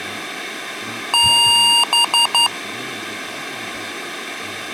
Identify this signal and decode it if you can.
Beep code, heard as beeps from a small speaker, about 940 Hz, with room echo and speech in English. 1 long, 3 short. In Award and IBM BIOS tables: video adapter failure; in AMI BIOS tables: memory failure.